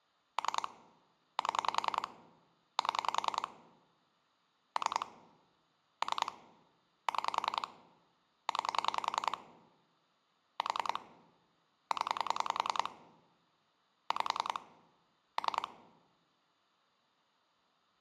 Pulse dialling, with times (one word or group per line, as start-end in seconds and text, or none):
0.4-0.7 3
1.4-2.1 7
2.8-3.5 7
4.8-5.1 3
6.0-6.3 3
7.1-7.7 6
8.5-9.4 9
10.6-11.0 4
11.9-12.9 0
14.1-14.6 5
15.4-15.7 3